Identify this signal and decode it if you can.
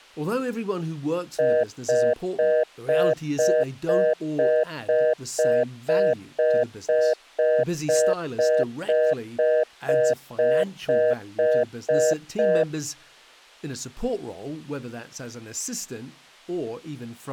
Telephone call progress tone (North American plan), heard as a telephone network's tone, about 480, 620 Hz, 0.25 s on and 0.25 s off, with speech in English. Congestion tone.